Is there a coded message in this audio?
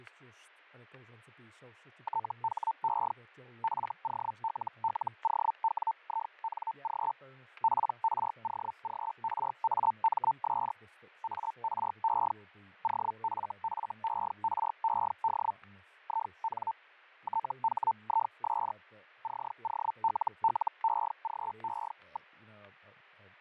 Yes: Hellschreiber (Feld-Hell, 122.5 baud) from 2.0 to 22.3 s, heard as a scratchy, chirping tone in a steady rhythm, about 900 Hz, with fading and static crashes. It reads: THE FOLLOWING PROGRAMS ARE OFFERED IN THIS COLLEGE.